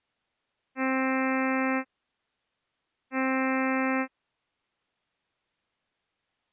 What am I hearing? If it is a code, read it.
Ship horn signal, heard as a ship's horn, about 260 Hz. 2 short. At sea: I am altering course to port.